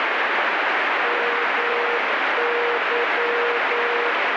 Morse code, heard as a keyed tone, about 9 wpm, 480 Hz, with heavy radio static. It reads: MY